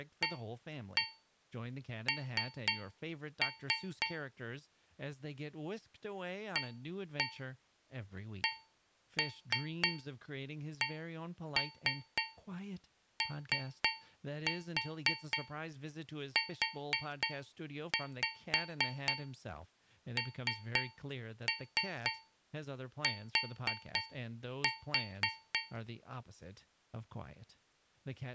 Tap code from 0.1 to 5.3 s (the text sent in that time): AN